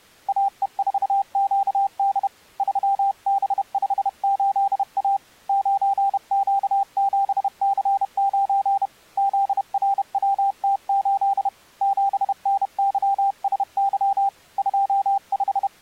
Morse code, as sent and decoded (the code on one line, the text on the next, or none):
.- . ....- --.- -.. / ...-- -... ..... ---.. .- / ----. --.- --... -.-. ----. / --.. .-. .-- - ---.. / --... -. -.-- ... -.-- / …
AE4QD 3B58A 9Q7C9 ZRWT8 7NYSY …